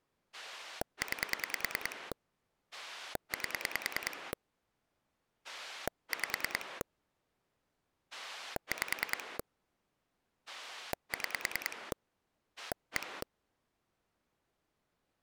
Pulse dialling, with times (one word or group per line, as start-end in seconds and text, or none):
0.3-2.1 9
2.7-4.3 8
5.4-6.8 5
8.1-9.4 5
10.5-11.9 6
12.6-13.2 1